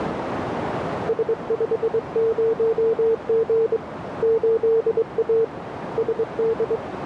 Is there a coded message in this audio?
Yes: Morse code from 1.0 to 6.8 s, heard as a keyed tone, hand-sent with a straight key, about 22 wpm, 450 Hz, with radio static and a narrow filter. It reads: S50G 8A SD